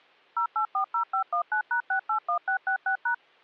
DTMF, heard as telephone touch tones, dialled by machine, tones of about 100 ms. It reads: 0840519#681666#